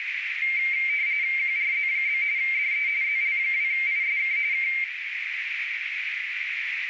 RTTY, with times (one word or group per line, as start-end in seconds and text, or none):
1.4-2.2 QRZ?
2.4-2.9 DE
3.0-4.4 ZL2ISK
4.5-4.7 K